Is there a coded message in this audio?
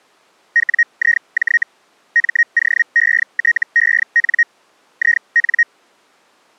Yes: Hellschreiber (Feld-Hell, 122.5 baud) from 0.6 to 5.6 s, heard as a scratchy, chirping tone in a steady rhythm, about 1900 Hz. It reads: WIJ MOETEN IN